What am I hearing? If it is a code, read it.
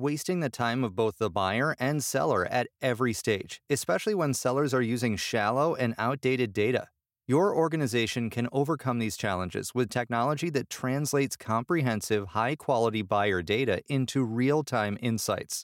Speech in English. There is no code.